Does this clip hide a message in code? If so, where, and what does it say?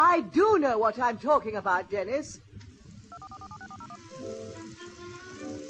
Yes: DTMF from 3.1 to 4.0 s, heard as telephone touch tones, dialled by machine, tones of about 60 ms. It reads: 244476401